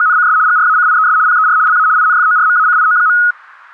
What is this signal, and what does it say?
RTTY (75 baud, 170 Hz shift), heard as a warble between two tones, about 1360 Hz centre, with static crashes. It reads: … GRACIES PER LA INFORMACIO.